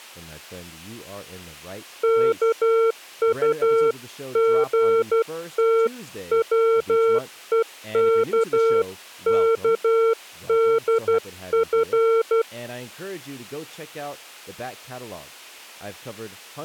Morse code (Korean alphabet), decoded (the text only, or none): 이서방은